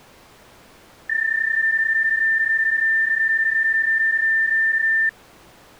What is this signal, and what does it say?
PSK31 (31.25 baud), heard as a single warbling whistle, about 1800 Hz.